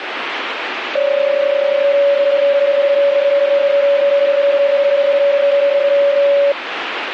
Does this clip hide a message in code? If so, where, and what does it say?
Yes: PSK31 (31.25 baud) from 1.0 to 6.5 s, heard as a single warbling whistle, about 560 Hz, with radio static.